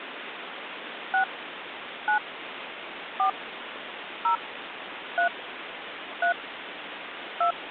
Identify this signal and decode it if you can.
DTMF, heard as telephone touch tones, dialled by hand, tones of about 100 ms, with phone line noise. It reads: 6 9 4 0 3 3 2